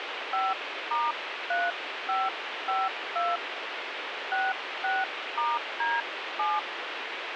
DTMF, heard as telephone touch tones, dialled by hand, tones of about 200 ms, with radio hiss. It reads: 5*3552 66*D7